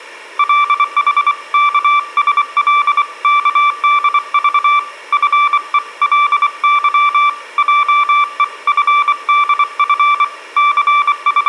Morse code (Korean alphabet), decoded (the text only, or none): 구역을 나게 하는 …